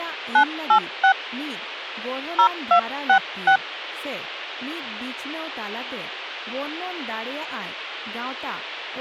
DTMF, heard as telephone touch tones, dialled by hand, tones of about 90 ms, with speech in Santali. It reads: 986 0266